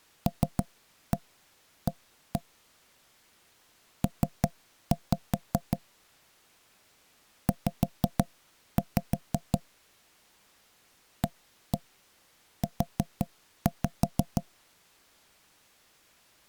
Tap code, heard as knocks on wood, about 5 knocks a second. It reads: LA P Z AU